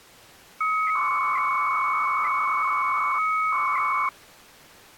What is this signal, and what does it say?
300-baud modem data (Bell 103 tones), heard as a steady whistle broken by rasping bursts, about 300 baud, 200 Hz shift.